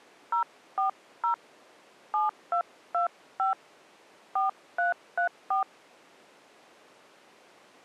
DTMF, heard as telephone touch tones, dialled by hand, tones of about 120 ms. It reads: 040 7225 4334